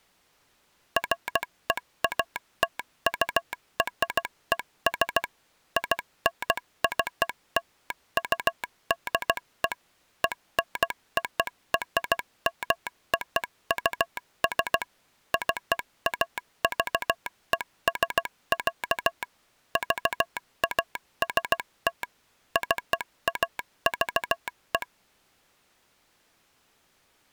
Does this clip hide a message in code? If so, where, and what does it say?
Yes: Morse code (American railroad code) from 0.9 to 24.9 s, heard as a telegraph sounder, machine-sent. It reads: FEATURES INCLUDE ENORMOUS CAVES, VAST CAVE